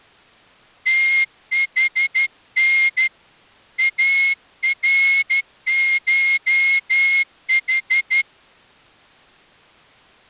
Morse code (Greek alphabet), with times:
0.9-3.1 ΤΗΝ
3.8-8.2 ΑΡΧΗ

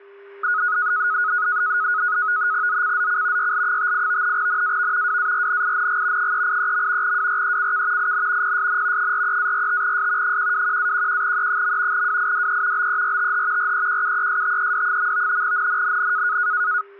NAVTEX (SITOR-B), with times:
2.7-3.5 ZCZC
3.4-4.4 YL58
4.4-5.2 NAV
5.1-6.3 WARNING
6.2-7.2 383.
7.0-8.1 WRECK
8.0-8.6 IN
8.4-9.1 PSN
9.0-10.4 43-45S
10.2-12.1 121-11E.
11.9-12.9 WIDE
12.8-13.7 BERTH
13.6-15.4 REQUESTED.
15.4-16.4 NNNN

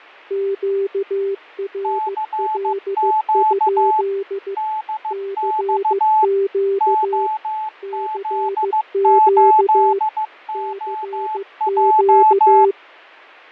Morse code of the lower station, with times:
0.3-4.5 QRL?
5.1-7.3 CQ
7.8-10.0 CQ
10.5-12.7 CQ

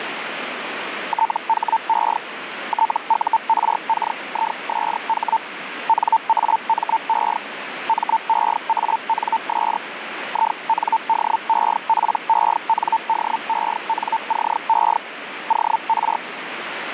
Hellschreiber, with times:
1.1-2.2 THE
2.7-5.4 TURKISH
5.9-7.4 NAME
7.9-9.8 MEANS
10.3-15.0 INDEPENDENCE
15.5-16.2 OR

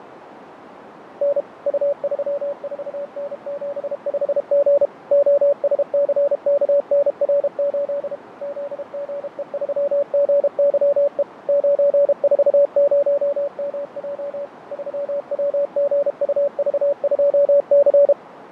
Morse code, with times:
1.2-1.4 N
1.7-4.9 U34N75G
5.1-8.2 OSCKNR8
8.4-11.2 ZGE3GYE
11.5-14.5 940MJ
14.7-18.1 3WGUV2C

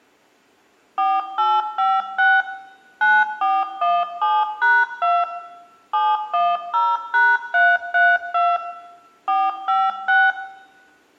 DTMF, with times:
1.0-2.4 4856
3.0-5.2 9417#2
5.9-8.6 710#332
9.3-10.3 456

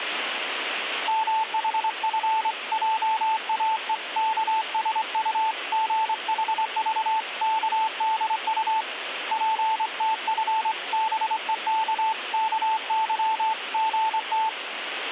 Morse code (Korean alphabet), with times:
1.1-8.8 문화예술의
9.3-14.5 전당에서

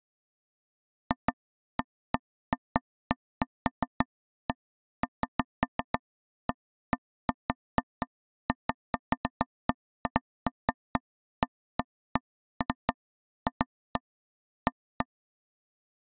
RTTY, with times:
none

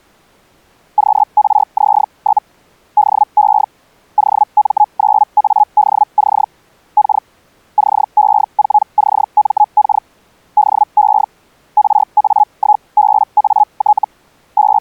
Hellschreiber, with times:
1.0-2.4 QRZ?
3.0-3.6 DE
4.2-6.4 OM9ADC
7.0-7.2 K
7.8-10.0 CE4CMK
10.6-11.2 DE
11.8-14.0 RA1BAT
14.6-14.8 …

